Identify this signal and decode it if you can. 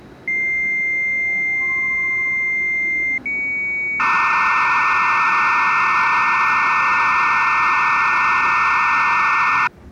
Dial-up modem handshake (low-speed, two carriers), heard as two whistles, then hiss, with the noise inside a subway train.